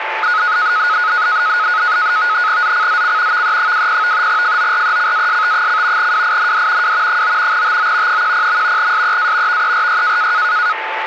NAVTEX (SITOR-B), 100 baud, 170 Hz shift, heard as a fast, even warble, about 1360 Hz centre, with radio static and a steady whistle near 880 Hz. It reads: ZCZC VE20 FORECAST: WIND W 9 TO 10. SEA VERY